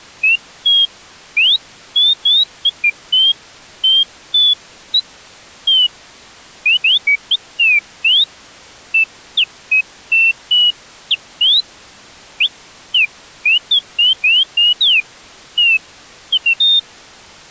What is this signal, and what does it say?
Bird-like chirps. There is no code.